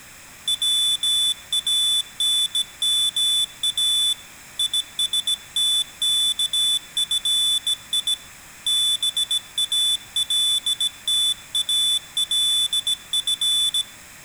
Morse code (Arabic alphabet), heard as a high beeper, hand-sent with a bug key, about 17 wpm, 3500 Hz, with room echo. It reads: وانما يستكفي بالتالف